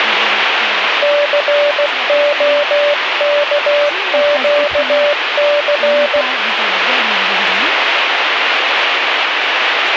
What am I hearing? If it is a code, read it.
Morse code, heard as a keyed tone, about 16 wpm, 580 Hz, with radio static and speech in French. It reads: COKQC